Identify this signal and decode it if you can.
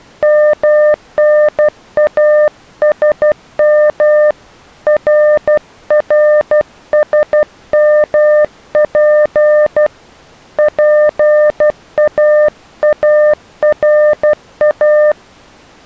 Morse code, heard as a keyed tone, hand-sent with a paddle, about 12 wpm, 600 Hz. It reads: MNASM RRSMP PAARA